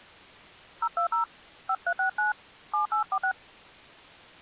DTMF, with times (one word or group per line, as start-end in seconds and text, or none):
0.8-1.2 020
1.7-2.3 5369
2.7-3.3 7846